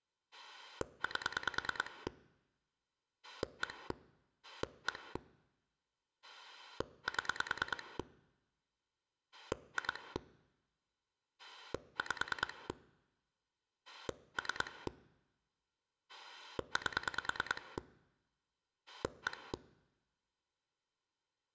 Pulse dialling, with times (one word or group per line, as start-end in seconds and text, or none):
0.3-2.1 8
3.2-3.9 1
4.4-5.2 1
6.2-8.0 7
9.3-10.2 2
11.4-12.7 5
13.9-14.9 3
16.1-17.8 8
18.9-19.5 1